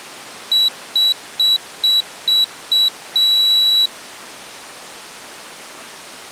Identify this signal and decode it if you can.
Beep code, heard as a piezo beeper, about 3900 Hz. 6 short, 1 long.